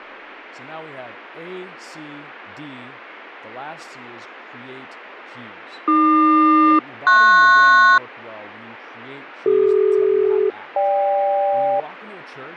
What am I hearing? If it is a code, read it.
Aircraft SELCAL, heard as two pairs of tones, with radio static, fading and speech in English. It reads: AQ-PS CD-GK